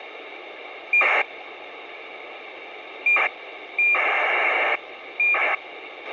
ACARS aircraft data, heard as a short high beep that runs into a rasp, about 2400 baud, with radio hiss and a squelch burst at the end.